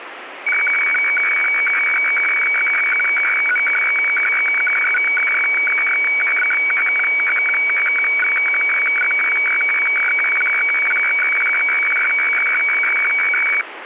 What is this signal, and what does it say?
Weather fax (radiofax), 120 lines a minute, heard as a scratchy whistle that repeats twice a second, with radio static.